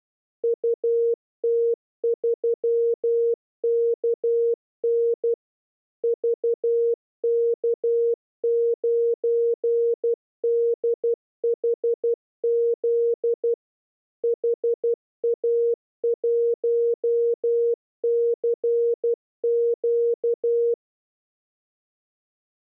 Morse code, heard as a keyed tone, machine-sent, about 12 wpm, 470 Hz. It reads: UT3KN VK9DHZ HA1CQ